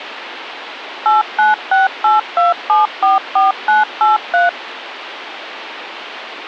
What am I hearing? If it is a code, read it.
DTMF, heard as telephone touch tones, dialled by machine, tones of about 160 ms, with phone line noise. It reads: 89682744983